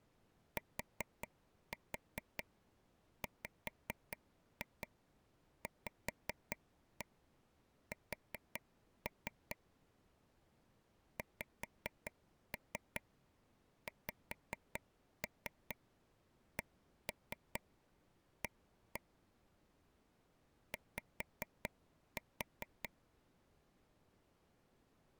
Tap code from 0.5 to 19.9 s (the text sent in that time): TWVS XXCA